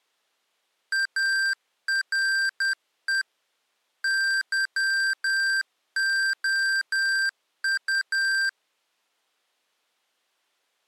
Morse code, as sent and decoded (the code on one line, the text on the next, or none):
.- .-. . / -.-- --- ..-
ARE YOU